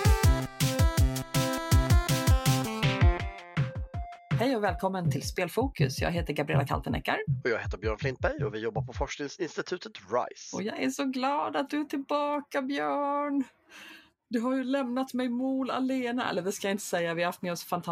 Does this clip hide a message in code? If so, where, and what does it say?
No.